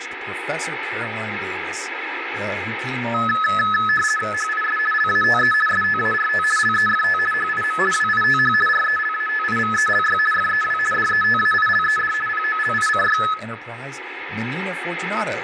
RTTY (50 baud, 450 Hz shift), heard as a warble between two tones, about 1500 Hz centre, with radio static, room echo and speech in English. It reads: HIS LATE START LEFT HIM WITH RELATIVELY FEW DETAILED POLICY